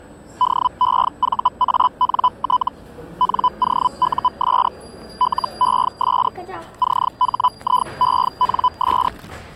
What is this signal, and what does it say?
Hellschreiber (Feld-Hell, 122.5 baud), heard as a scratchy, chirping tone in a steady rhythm, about 1000 Hz, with the noise of a cafe. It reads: DEVANT NOUS LES CHIENS